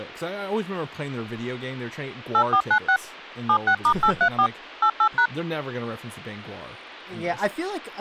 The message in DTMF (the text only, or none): 8496 76*834 88#